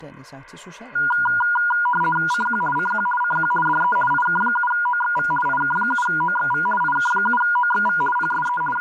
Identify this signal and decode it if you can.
RTTY (50 baud, 450 Hz shift), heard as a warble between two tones, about 1200 Hz centre, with speech in Danish. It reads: CQ CQ CQ DE IK7OXV IK7OXV IK7OXV PSE …